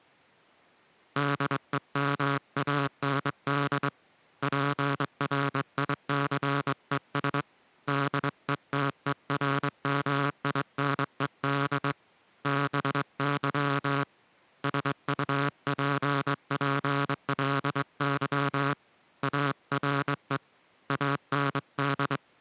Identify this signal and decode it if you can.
Morse code, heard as a buzzer, hand-sent with a straight key, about 22 wpm. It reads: DEMAND PRICES DETERMINED BY SUPPLY ARE AND